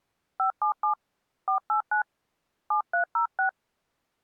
DTMF, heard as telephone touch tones, dialled by hand, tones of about 110 ms. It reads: 577 489 7306